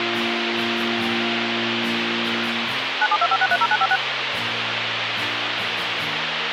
DTMF, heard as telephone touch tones, dialled by machine, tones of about 50 ms, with radio hiss. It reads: 9725630956